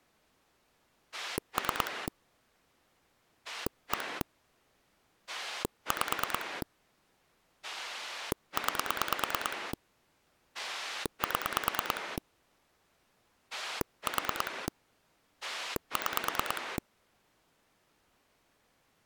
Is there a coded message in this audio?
Yes: pulse dialling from 1.1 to 16.8 s, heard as a rotary dial, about 9 pulses a second. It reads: 3 1 5 9 7 4 6